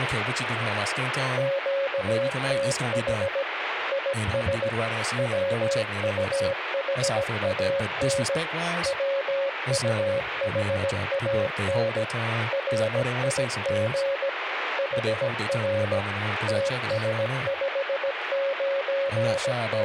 Morse code, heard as a keyed tone, machine-sent, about 17 wpm, 550 Hz, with radio static and speech in English. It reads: QTH IS WUHAN WUHAN RIG HR …